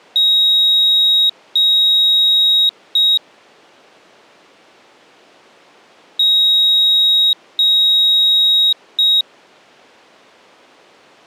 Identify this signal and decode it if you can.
Beep code, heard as a piezo beeper, played twice, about 3800 Hz. 2 long, 1 short.